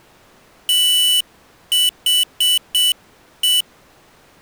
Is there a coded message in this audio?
Yes: Morse code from 0.6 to 3.7 s, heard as a high beeper, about 7 wpm, 2950 Hz. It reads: THE